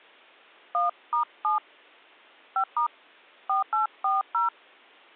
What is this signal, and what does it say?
DTMF, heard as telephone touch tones, dialled by hand, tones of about 140 ms. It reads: 1*7 5* 4840